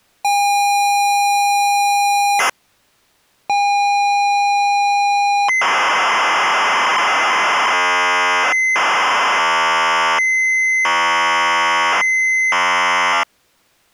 ZX Spectrum tape loading, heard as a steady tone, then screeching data.